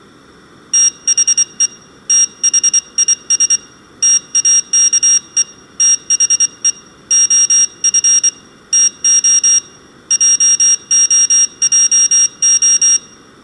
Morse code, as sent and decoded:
- .... . / - .... .. ... / - .- -.- . / - .... . / --- ..-. / - --- / .--- --- .--- ---
THE THIS TAKE THE OF TO JOJO

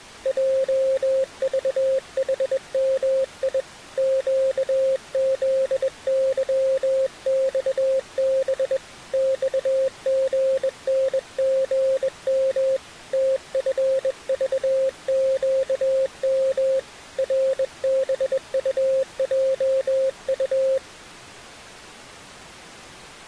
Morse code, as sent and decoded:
.--- ...- .... -- .. / --.- --.. -.-- -..- -... / -..- --. -. --. -- / - ..-. ...- --.- -- / .-. -... ..- .--- ..-
JVHMI QZYXB XGNGM TFVQM RBUJU

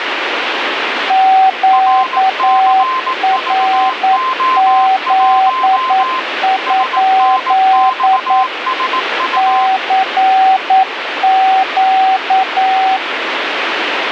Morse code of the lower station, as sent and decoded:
--.- .-. --.. ..--.. / -.-. --.-
QRZ? CQ

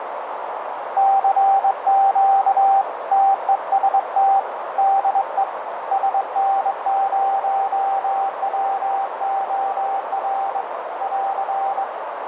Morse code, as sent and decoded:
-.-. --.- / - . ... - / -.. . / ... -. ----- .-- --- .-. / .-.-.
CQ TEST DE SN0WOR <AR>

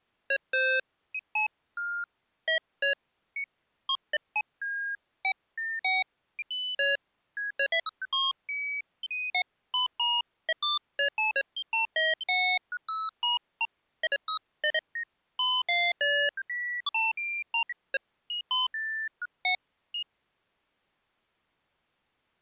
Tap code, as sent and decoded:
none

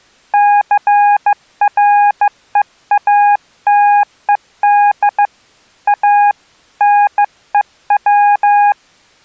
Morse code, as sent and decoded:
-.-. .-. . .- - . -.. / .- / -. . .--
CREATED A NEW

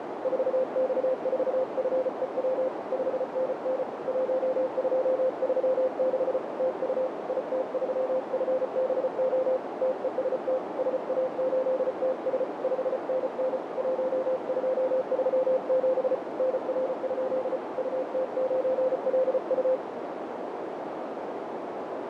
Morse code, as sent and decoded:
....- -..- ....- ..-. . .-- / ..... -. -. / .---- ..--- ...-- -.... / - ..- / .. - ...-- ..-. -... --- / - . ... - / ... .- ---.. - ... / ..... -. -. / .---- ..--- ...-- --... / -. .-. ..--.. / ..- - ----. .-.. ..-
4X4FEW 5NN 1236 TU IT3FBO TEST SA8TS 5NN 1237 NR? UT9LU

